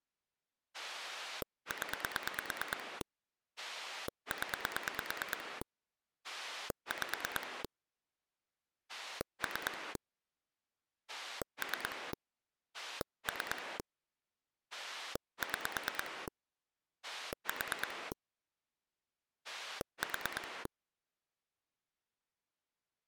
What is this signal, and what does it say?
Pulse dialling, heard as a rotary dial, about 9 pulses a second. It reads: 0 0 5 3 3 3 6 4 4